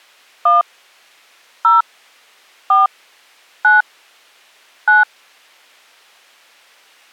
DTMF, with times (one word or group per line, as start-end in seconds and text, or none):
0.5-0.6 1
1.6-1.8 0
2.7-2.9 4
3.6-3.8 9
4.9-5.0 9